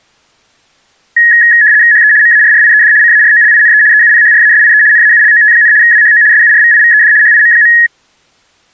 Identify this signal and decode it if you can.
RTTY (75 baud, 170 Hz shift), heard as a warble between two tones, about 1800 Hz centre. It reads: HE MARRIED CAROLINE EUPHRASIE NAULOT, WHO SURVIVED HIM.